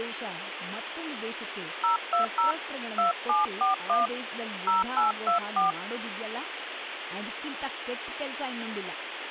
DTMF, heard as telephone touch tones, dialled by hand, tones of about 130 ms, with phone line noise and speech in Kannada. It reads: 020 2741 0824